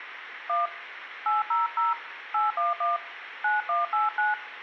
DTMF, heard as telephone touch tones, dialled by hand, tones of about 160 ms, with phone line noise. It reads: 1 800 811 9189